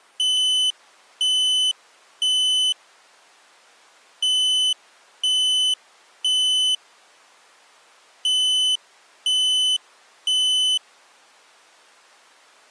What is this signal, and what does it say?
Alarm pattern, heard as an alarm's beeps, played three times, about 3000 Hz. Temporal three. Smoke or fire, evacuate.